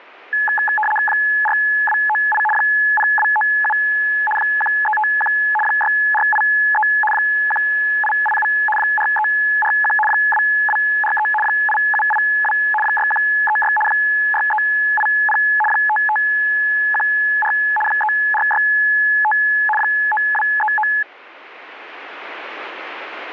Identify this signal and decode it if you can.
RTTY (75 baud, 850 Hz shift), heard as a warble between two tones, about 1280 Hz centre. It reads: 4298 0297 1351 6483 1887 4341 2243 8782 6136 6380 5514 3465 9239